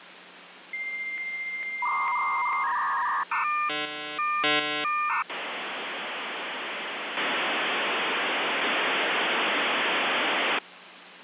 Dial-up modem handshake (V.34 or later), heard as a whistle, warbles, then hiss, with phone line noise.